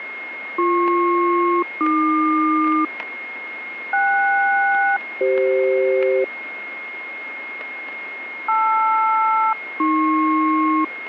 Aircraft SELCAL, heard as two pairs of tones, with radio static, static crashes and a steady whistle near 2150 Hz. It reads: BP-AQ KS-CF LR-AP